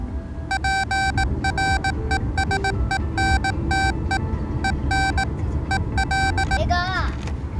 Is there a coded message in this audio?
Yes: Morse code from 0.4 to 6.6 s, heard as electronic beeps, machine-sent, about 18 wpm, 780 Hz, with the noise inside a car. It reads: PRESENTE EN EL